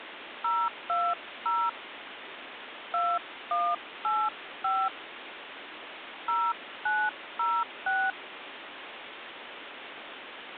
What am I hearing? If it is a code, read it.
DTMF, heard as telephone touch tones, dialled by hand, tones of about 240 ms, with phone line noise. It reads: 020 2185 0906